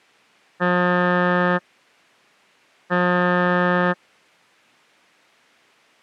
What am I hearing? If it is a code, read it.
Ship horn signal, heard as a ship's horn, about 180 Hz. 2 short. At sea: I am altering course to port.